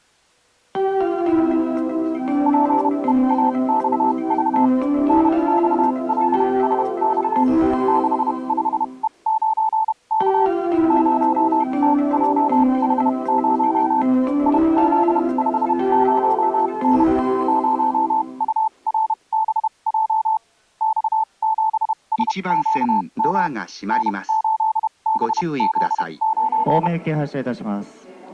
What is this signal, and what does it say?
Morse code, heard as a keyed tone, machine-sent, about 31 wpm, spaced as for 25 wpm, 880 Hz. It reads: PEAXV NXLSX 65E9K 0TJH0 IZ50N 0URBJ X7SQM N8BZ9